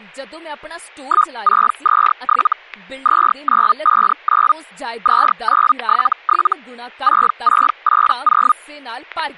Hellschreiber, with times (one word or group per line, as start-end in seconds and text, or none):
1.0-2.5 1627
3.0-4.5 2959
5.0-6.5 2977
7.0-8.5 6680